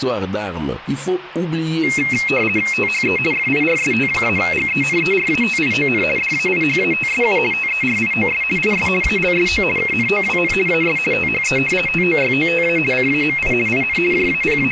RTTY (50 baud, 450 Hz shift), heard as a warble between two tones, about 2350 Hz centre. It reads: THE FIRST-GENERATION DAIHATSU TERIOS IS ALSO KNOWN AS THE TOYOTA CAMI IN …